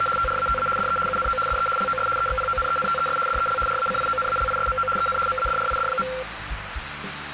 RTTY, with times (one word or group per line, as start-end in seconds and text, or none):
0.0-0.1 …
0.2-0.7 TRATA
0.8-1.0 DE
1.1-1.4 UNO
1.5-1.7 DE
1.8-2.1 LOS
2.2-3.2 EXPONENTES
3.3-3.6 DEL
3.7-4.9 RACIONALISMO
5.0-5.2 EN
5.3-6.1 MADRID.